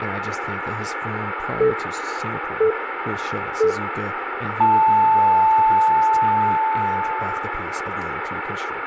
Radio time signal (three low pips and a long one an octave up, as on NHK), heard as pips, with radio static, room echo and speech in English.